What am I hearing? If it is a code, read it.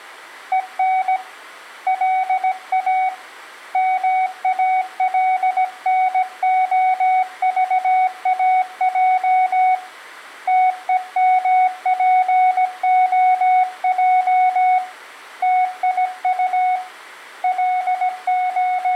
Morse code, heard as a keyed tone, hand-sent with a paddle, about 17 wpm, 740 Hz, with room echo. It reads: EN LA MALNOVAJ TEMPOJ TIU …